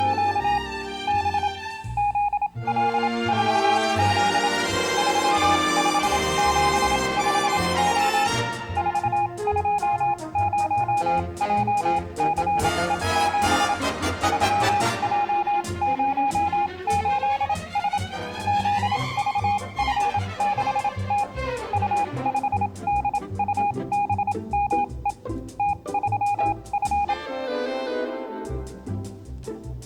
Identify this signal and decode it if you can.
Morse code, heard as a keyed tone, machine-sent, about 27 wpm, spaced as for 22 wpm, 820 Hz. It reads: … B ZL4Z 3575O 420JCE7 3J08S ZVF6T U5DUBME T3F